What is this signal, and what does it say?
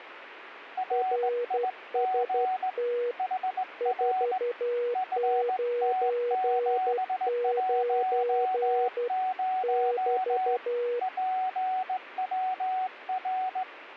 Morse code, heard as two keyed tones, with radio static. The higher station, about 18 wpm, 750 Hz: RIG HR FT710 PWR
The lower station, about 12 wpm, 480 Hz: RST 499 <BT>